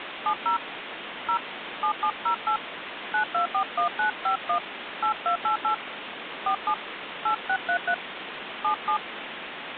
DTMF, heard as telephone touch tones, dialled by hand, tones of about 90 ms, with phone line noise. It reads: 70 0 7708 9241951 8288 47 8633 77